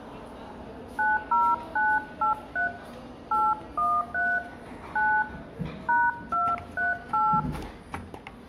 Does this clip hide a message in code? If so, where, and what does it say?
Yes: DTMF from 1.0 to 7.4 s, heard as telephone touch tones, dialled by hand, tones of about 200 ms, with room echo and the noise of a cafe. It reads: 90983 813 9 #238